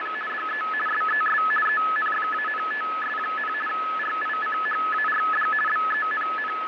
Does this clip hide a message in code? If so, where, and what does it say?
Yes: RTTY (50 baud, 450 Hz shift) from 0.0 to 6.7 s, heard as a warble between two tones, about 1500 Hz centre, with radio static and fading. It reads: … DE SES ENFANTS, RICHARD …